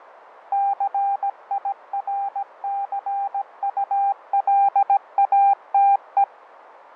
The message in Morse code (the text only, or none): CIRCULATE